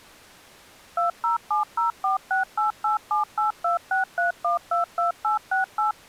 DTMF, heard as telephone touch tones, dialled by machine, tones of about 130 ms. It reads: 2070468878263122868